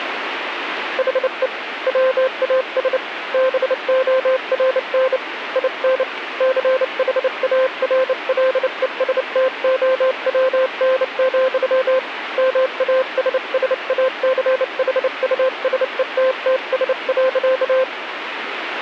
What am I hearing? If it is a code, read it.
Morse code, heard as a keyed tone, hand-sent with a bug key, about 29 wpm, 520 Hz, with radio static. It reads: HE WAS BORN IN CHARLESTOWN, MASSACHUSETTS.